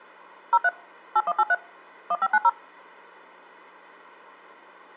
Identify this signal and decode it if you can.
DTMF, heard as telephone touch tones, dialled by machine, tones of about 50 ms. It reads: 03 8183 1590